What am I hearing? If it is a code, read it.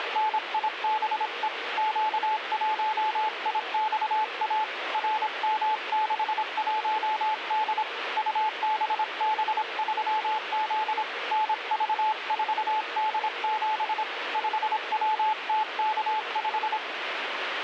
Morse code, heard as a keyed tone, hand-sent with a paddle, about 26 wpm, 860 Hz, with radio static. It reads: … Q1IXA RM61D UBB3Z NV4D7 5WTK5